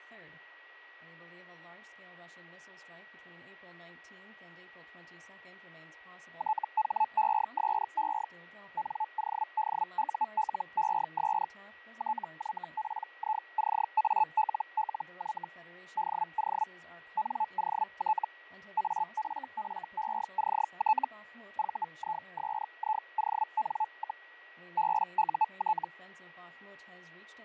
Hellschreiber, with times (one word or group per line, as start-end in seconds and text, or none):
6.4-8.3 THESE
8.8-11.5 NODULES
12.0-15.5 TYPICALLY
16.0-16.7 DO
17.2-18.3 NOT
18.8-21.1 AFFECT
21.6-24.3 VISION,
24.8-25.9 BUT